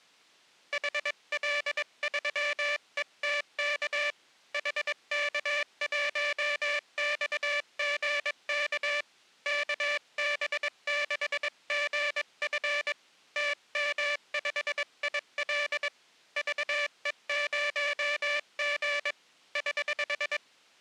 Morse code, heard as a buzzer, hand-sent with a paddle, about 22 wpm. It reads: HL3ETK HK1XGK KB6GF TM5IL VE0G <HH>